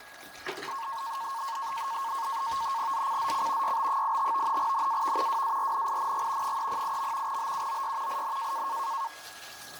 NAVTEX (SITOR-B), 100 baud, 170 Hz shift, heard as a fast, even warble, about 1000 Hz centre, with radio static, fading, a steady whistle near 1660 Hz and kitchen noise. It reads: ZCZC YB85 NAV WARNING 308. BUOY IN